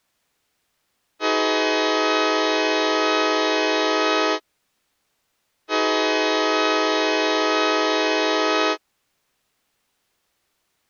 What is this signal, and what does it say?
Train horn signal, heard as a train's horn. 2 long. On North American railways: brakes released, proceed.